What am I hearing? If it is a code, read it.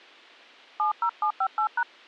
DTMF, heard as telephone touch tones, dialled by hand, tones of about 90 ms. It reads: 70758#